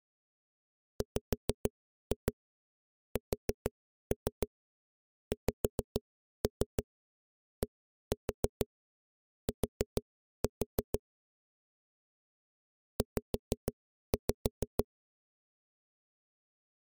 Tap code, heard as knocks on a wall, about 6 knocks a second. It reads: WSXDT Z